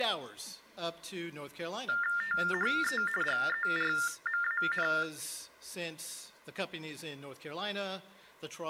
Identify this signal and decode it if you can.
TTY/TDD text telephone tones (45.45 baud Baudot), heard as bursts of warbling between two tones, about 400 Hz shift, 1600 Hz centre. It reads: THE GERMAN